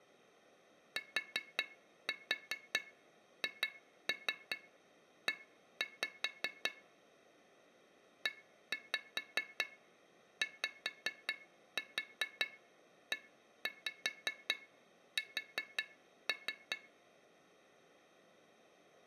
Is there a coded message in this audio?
Yes: tap code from 1.0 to 16.8 s, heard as taps on glass, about 5 knocks a second. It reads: THE EYES